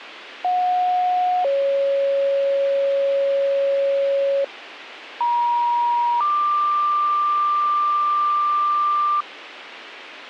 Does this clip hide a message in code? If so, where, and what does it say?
Yes: two-tone page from 0.4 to 9.2 s, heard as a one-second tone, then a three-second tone, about 730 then 550 Hz, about 950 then 1180 Hz, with radio hiss and a squelch burst at the end.